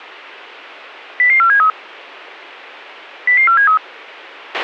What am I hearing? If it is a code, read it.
Five-tone selective call (CCIR), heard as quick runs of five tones, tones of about 100 ms, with a squelch burst at the end. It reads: 00473 00473